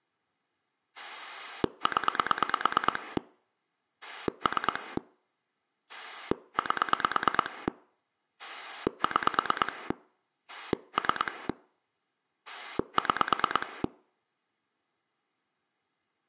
Pulse dialling, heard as a rotary dial, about 9 pulses a second. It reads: 0 3 8 6 3 6